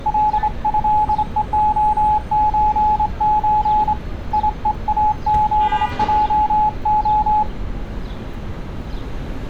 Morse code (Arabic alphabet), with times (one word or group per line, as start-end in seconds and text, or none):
0.1-3.9 لهءخزز
4.3-7.4 يءاذجخ